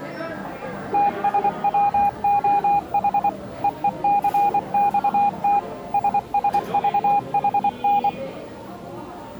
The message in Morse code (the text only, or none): TSWOH EECXT SSVHN